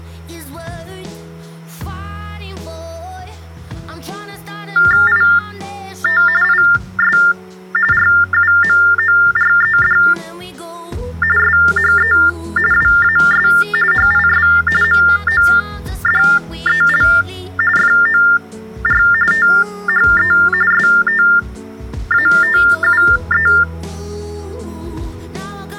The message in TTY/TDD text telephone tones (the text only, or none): IT IS RUMORED SHE WAS HIS MODEL FOR THE STATUE